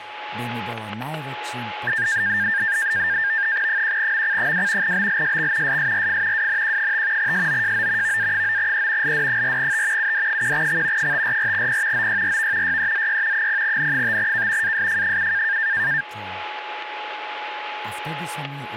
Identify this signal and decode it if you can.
NAVTEX (SITOR-B), 100 baud, 170 Hz shift, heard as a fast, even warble, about 1700 Hz centre, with static crashes and a steady whistle near 840 Hz. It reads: 1MC2 BLSX SSRF WNQ5 SOJO VA9E LD4T UD1X 544P OYRV YEZY 0N5K ASF7